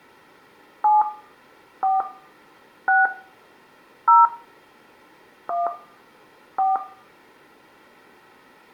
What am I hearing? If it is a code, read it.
DTMF, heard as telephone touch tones, dialled by hand, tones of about 170 ms, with room echo. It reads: 7 4 6 0 1 4